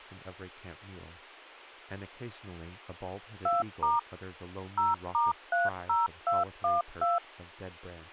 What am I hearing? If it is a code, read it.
DTMF, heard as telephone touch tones, dialled by machine, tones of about 170 ms, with speech in English. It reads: 2* 0*30212